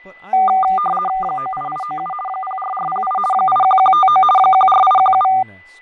RTTY (50 baud, 450 Hz shift), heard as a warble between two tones, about 980 Hz centre, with fading, a steady whistle near 2000 Hz and speech in English. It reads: 98897 04408 81159 14817